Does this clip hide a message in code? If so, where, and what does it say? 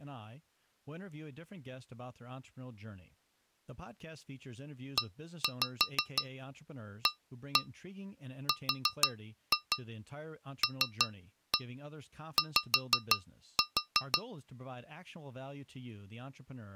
Yes: tap code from 5.0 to 14.3 s, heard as taps on glass, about 6 knocks a second, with speech in English. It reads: EARLY